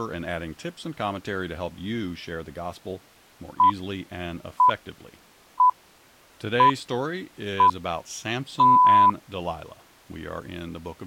Radio time signal (six pips, as the Greenwich Time Signal), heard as pips, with speech in English.